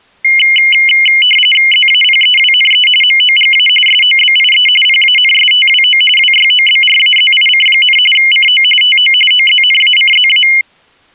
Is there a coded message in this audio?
Yes: RTTY (45.45 baud, 850 Hz shift) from 0.2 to 10.6 s, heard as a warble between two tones, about 2550 Hz centre. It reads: ZAPEWNE MOGA SOBIE PANSTWO WYOBRAZIC, CO TO OZNACZA